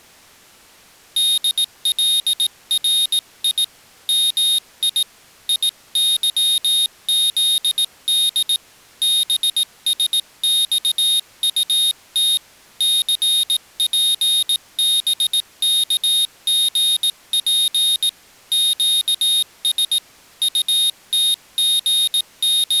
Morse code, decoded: DLRI MI IYZD BSXUT CPBKGP QS …

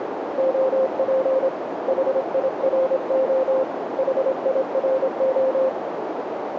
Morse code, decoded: OP HIRO HIRO

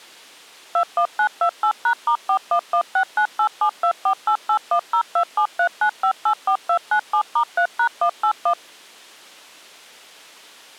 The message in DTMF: 21928#*41169872488102739584297*3#181

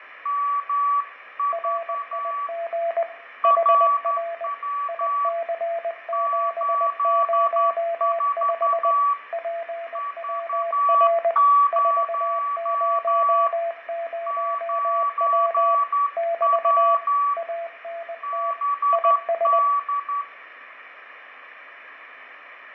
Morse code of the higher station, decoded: MV RW 84 V0 9W BD

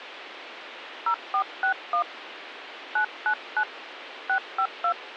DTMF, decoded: 0461 999 652

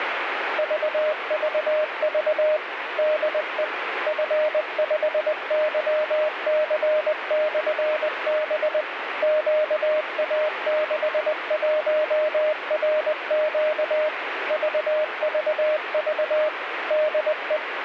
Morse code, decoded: VVV DE F5YC/B QA61RQ VVV DE

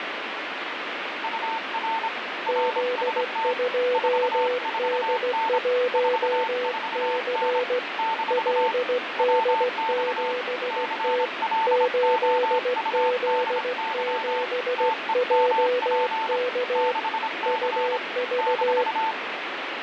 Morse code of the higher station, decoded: UR RST 44N 44N - WX CLOUDY TEMP 6C -

